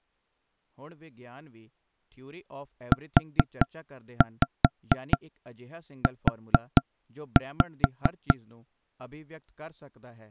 Tap code, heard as knocks on wood, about 4 knocks a second, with speech in Punjabi. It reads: UU